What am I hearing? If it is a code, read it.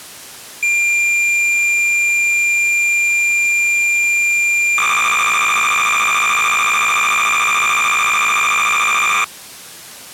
Cassette data (Kansas City type), 300 baud, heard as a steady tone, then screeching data.